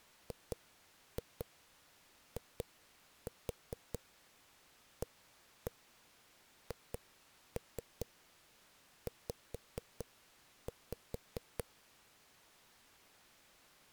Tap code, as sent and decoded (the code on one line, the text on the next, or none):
2-2 2-4 1-1 2-3 5-5
GIAHZ